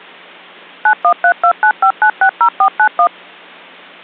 DTMF, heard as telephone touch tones, dialled by machine, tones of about 80 ms. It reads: 913295960491